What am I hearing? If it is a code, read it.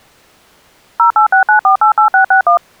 DTMF, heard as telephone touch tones, dialled by machine, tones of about 110 ms. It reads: 0869488661